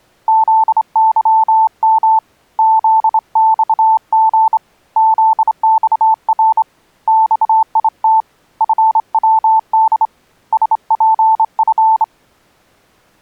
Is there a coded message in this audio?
Yes: Morse code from 0.2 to 12.1 s, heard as a keyed tone, hand-sent with a straight key, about 26 wpm, 880 Hz. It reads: ZYM ZXG ZXR XIT FWD SPF